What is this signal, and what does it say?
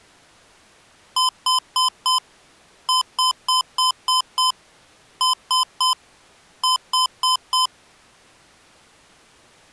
Beep code, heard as beeps from a small speaker, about 1020 Hz. 4-6-3-4.